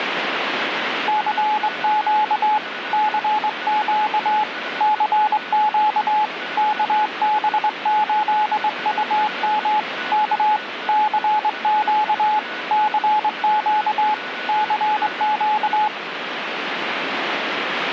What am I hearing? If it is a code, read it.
Morse code, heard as a keyed tone, hand-sent with a straight key, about 23 wpm, 850 Hz, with radio static and a weaker station near 1480 Hz. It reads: CQ CQ CQ KB8UM K CQ CQ CQ